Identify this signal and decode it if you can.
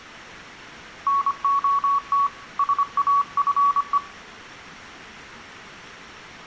Morse code, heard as a keyed tone, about 25 wpm, 1120 Hz, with room echo. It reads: NOT SAFE